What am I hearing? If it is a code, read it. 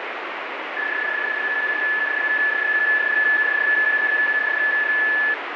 PSK31 (31.25 baud), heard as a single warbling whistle, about 1750 Hz, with radio static.